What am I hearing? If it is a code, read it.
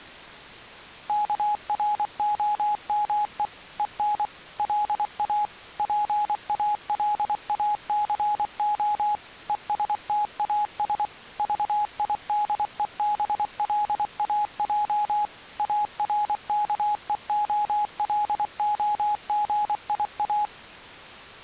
Morse code, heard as a keyed tone, machine-sent, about 24 wpm, 840 Hz. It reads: KROME EN LA PALACO ESTAS VIDEBLAJ ARKEOLOGIA